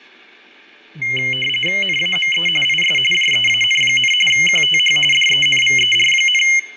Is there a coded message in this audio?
Yes: RTTY (45.45 baud, 850 Hz shift) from 1.0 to 6.6 s, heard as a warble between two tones, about 2550 Hz centre, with radio static, fading, room echo and speech in Hebrew. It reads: NAME IS JEAN, QTH DENVER,